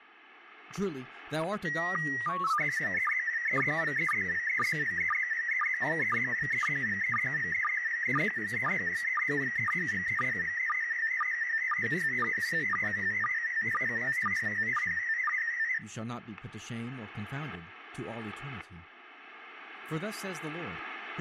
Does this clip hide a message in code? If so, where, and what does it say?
Yes: SSTV (slow-scan television), PD 120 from 1.7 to 15.8 s, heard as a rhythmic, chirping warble, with static crashes and speech in English.